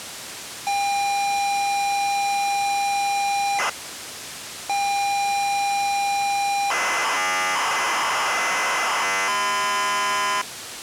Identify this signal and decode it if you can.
ZX Spectrum tape loading, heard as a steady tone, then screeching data, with tape hiss.